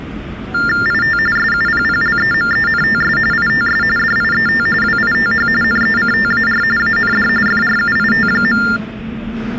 TTY/TDD text telephone tones (45.45 baud Baudot), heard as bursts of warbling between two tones, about 400 Hz shift, 1600 Hz centre, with the noise inside a subway train. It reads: IT SUPPLEMENTS ITS DIET WITH NECTAR AND FRUIT.